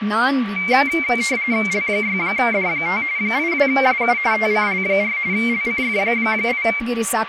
RTTY (45.45 baud, 170 Hz shift), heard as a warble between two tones, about 2200 Hz centre, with radio static, a steady whistle near 1150 Hz and speech in Kannada. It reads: L6D5 82SU TCL4 LCF8